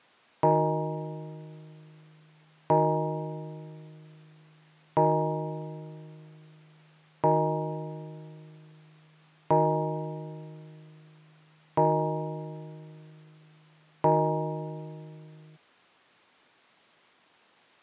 Clock strike, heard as a bell. 7. Seven o'clock.